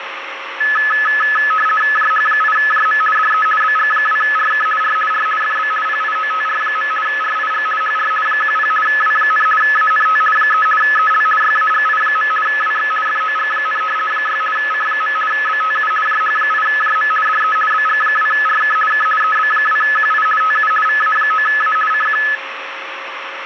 RTTY (50 baud, 450 Hz shift), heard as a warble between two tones, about 1500 Hz centre, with radio static and a steady whistle near 540 Hz. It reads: JH8JM DE BG2RK R R FB PIOTR. RIG HR 10 W, ANT 3 EL YAGI. WX FOG, 6 C. BTU JH8JM DE BG2RK K EB2QI TU VA9A CQ